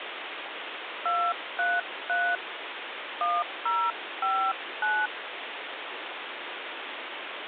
DTMF, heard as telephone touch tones, dialled by hand, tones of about 270 ms, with phone line noise. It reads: 233 1059